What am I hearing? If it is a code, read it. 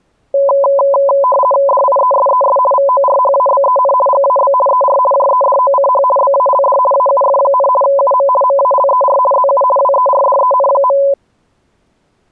RTTY (50 baud, 450 Hz shift), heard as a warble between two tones, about 780 Hz centre. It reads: DIESES VORHABEN GAB ER JEDOCH BALD AUF, UM MALER ZU WERDEN.